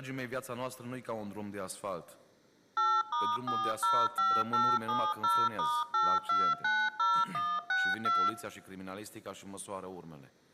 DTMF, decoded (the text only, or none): 8*405870*8290162